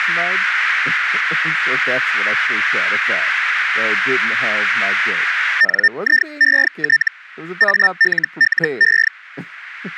Hellschreiber (Feld-Hell, 122.5 baud), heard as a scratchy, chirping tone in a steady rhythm, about 1800 Hz, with speech in English. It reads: NIET ALLE